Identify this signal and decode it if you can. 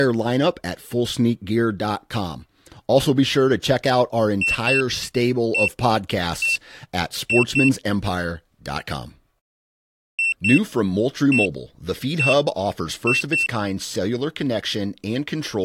Beep code, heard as a piezo beeper, played twice, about 2700 Hz, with speech in English. 2-1-1-2.